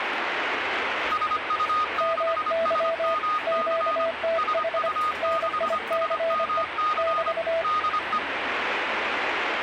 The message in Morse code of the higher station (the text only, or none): SU6SMC SU6SMC DE